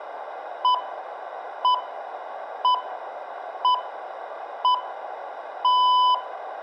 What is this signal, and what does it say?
Radio time signal (six pips, as the Greenwich Time Signal), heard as pips, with room echo.